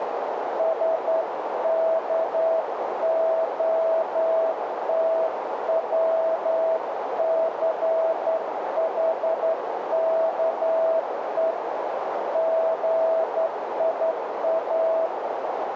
Morse code (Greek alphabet), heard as a keyed tone, hand-sent with a straight key, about 11 wpm, 650 Hz, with heavy radio static and a narrow filter. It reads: ΣΚΟΤΩΘΗΚΕ ΓΙΑ